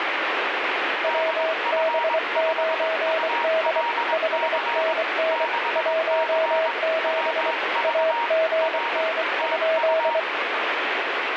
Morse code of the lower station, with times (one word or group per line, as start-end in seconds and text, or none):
1.0-3.8 WB9D
4.1-5.5 5NN
5.8-7.5 17
7.8-10.2 AGN?